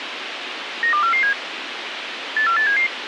Five-tone selective call (CCIR), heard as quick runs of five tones, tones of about 100 ms, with radio hiss and a squelch burst at the end. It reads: 92447 84877